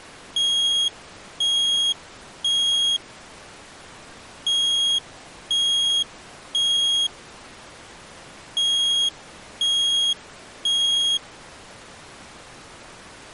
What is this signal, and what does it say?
Alarm pattern, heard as an alarm's beeps, played three times, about 3300 Hz. Temporal three. Smoke or fire, evacuate.